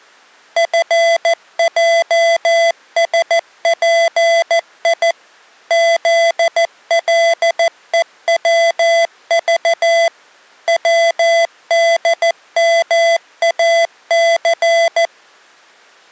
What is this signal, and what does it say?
Morse code, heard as electronic beeps, machine-sent, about 14 wpm, 670 Hz. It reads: FJSPI ZLEWV WDMAC